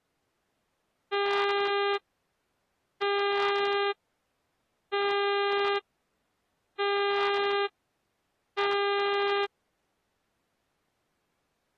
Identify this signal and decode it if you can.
Ship horn signal, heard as a ship's horn, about 400 Hz. 5 short. At sea: I doubt that you are doing enough to avoid a collision.